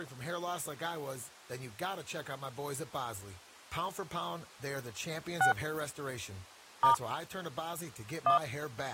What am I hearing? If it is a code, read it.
DTMF, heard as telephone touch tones, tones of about 110 ms, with speech in English. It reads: 6 * 1